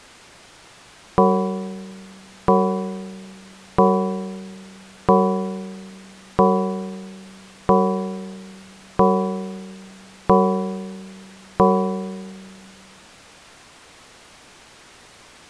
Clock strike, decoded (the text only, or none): 9